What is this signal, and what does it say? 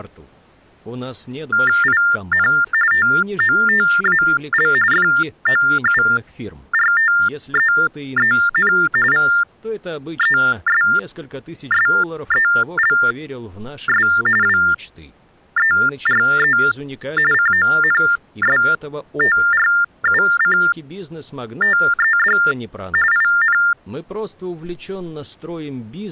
TTY/TDD text telephone tones (45.45 baud Baudot), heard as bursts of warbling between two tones, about 400 Hz shift, 1600 Hz centre. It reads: IN TOTAL FOURTEEN VESSELS WERE CONSTRUCTED IN